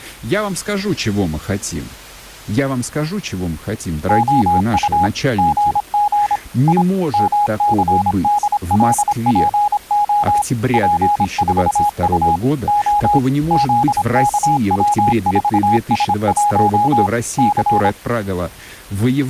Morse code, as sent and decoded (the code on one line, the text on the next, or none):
--- ..- / --. --. / .. / -- -.-. -.. .-.. .--. --- / .--. ....- ..- / --- / --.. -.- .-- ....- ... .---- / -.-.
OU GG I MCDLPO P4U O ZKW4S1 C